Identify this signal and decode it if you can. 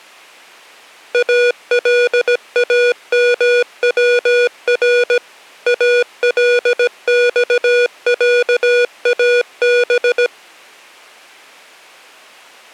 Morse code (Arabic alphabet), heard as electronic beeps, machine-sent, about 17 wpm, 480 Hz. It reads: الامور الصعاب